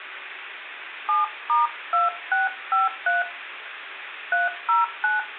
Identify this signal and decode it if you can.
DTMF, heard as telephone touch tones, dialled by hand, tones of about 160 ms, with phone line noise. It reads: 7*2653 309